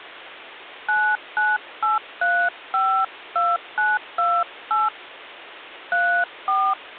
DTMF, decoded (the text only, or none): 998352928 34